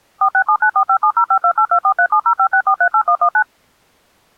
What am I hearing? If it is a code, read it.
DTMF, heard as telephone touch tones, dialled by machine, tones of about 80 ms. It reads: 467945705282437056438119